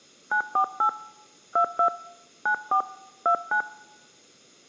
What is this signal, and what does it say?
DTMF, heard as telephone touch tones, dialled by hand, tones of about 90 ms. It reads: 948 22 94 29